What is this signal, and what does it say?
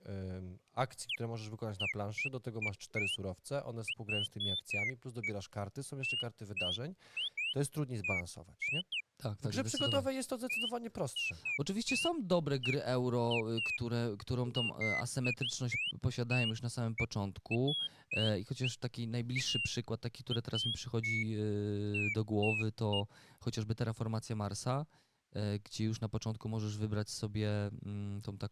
Bird-like chirps, with speech in Polish. There is no code.